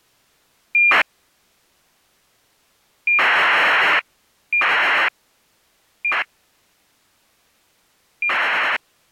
ACARS aircraft data, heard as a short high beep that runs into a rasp, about 2400 baud.